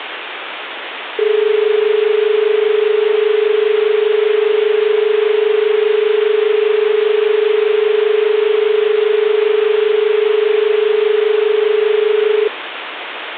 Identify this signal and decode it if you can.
Telephone call progress tone (as in Australia), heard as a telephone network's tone, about 430 Hz, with phone line noise. Dial tone.